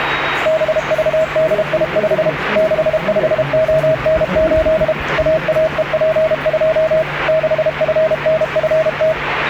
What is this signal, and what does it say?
Morse code, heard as a keyed tone, machine-sent, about 32 wpm, 640 Hz, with radio static and the noise of a subway station. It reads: BVDI5 65ON8 AAEP2 6FNFT